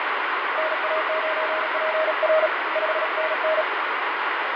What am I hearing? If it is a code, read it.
Morse code, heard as a keyed tone, hand-sent with a paddle, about 37 wpm, 630 Hz, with heavy radio static and fading. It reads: NA9PR 5NN